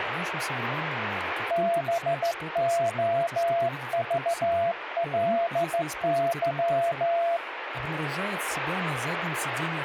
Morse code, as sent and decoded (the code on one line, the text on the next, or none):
-... --- ...- .-.. -.--
BOVLY